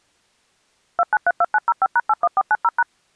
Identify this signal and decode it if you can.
DTMF, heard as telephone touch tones, dialled by machine, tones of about 40 ms. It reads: 2932905#81490#